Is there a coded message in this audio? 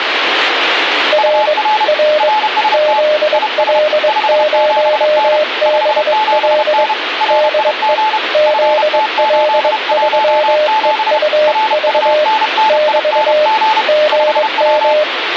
Yes: Morse code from 1.1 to 15.1 s, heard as two keyed tones, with radio static. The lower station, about 22 wpm, 610 Hz: R R ZL0BL DE ZL3EUV <BT> GM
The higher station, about 31 wpm, 870 Hz: UR RST IS 57N 57N RIG FT817 RUNNING 5W